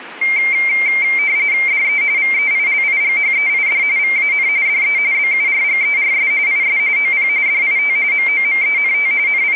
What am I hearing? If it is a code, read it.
RTTY (45.45 baud, 170 Hz shift), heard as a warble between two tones, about 2200 Hz centre. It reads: DE VEILIGHEID VAN DE BURGERS IS OP DIT MOMENT …